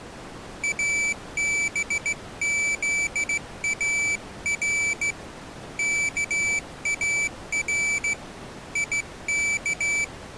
Morse code (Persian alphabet), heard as a high beeper, hand-sent with a straight key, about 15 wpm, 2300 Hz. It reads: ابزار کار یک